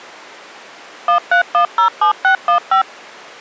DTMF, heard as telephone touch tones, dialled by machine, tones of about 100 ms. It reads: 13107615